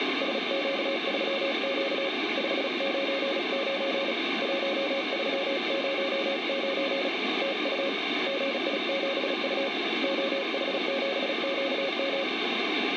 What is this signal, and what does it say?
Morse code, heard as a keyed tone, hand-sent with a paddle, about 36 wpm, 550 Hz, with radio static. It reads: SQ3Q 599 1309 TU GI7U OH7QM